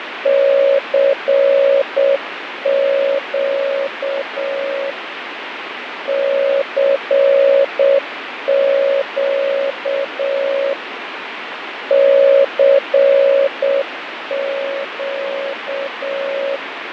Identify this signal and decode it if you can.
Morse code, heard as a keyed tone, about 7 wpm, 550 Hz, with radio static and fading. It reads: CQ CQ CQ